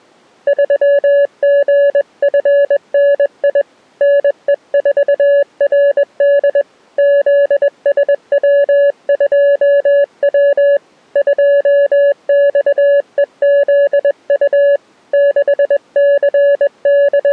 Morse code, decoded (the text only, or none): 3GFNI NE4RD ZSW2W 2XEZU …